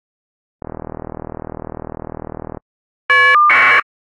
Caller ID data burst, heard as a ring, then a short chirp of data, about 1200 baud.